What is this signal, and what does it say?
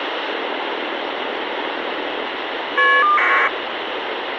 Caller ID data burst, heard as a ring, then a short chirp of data, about 1200 baud, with phone line noise.